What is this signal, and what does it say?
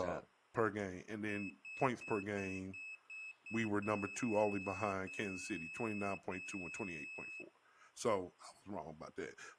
Beep code, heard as a piezo beeper, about 2600 Hz, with speech in English. 7 short, 3 long.